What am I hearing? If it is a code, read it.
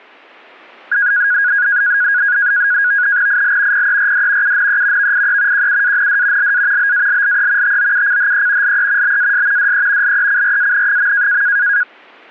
NAVTEX (SITOR-B), 100 baud, 170 Hz shift, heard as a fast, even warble, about 1550 Hz centre. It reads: IL PERD UNE VIE QUAND LA BALLE TOUCHE LE BAS DE LECRAN.